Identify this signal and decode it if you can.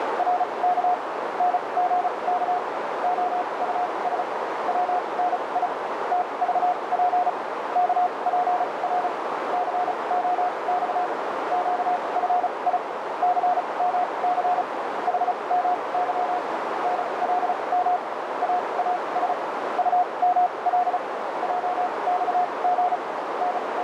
Morse code, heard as a keyed tone, machine-sent, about 35 wpm, spaced as for 26 wpm, 720 Hz, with heavy radio static and a narrow filter. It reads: … NGK OUS WNI TVP KPR COX QFI CMC HMY NLM AAS UML JXG …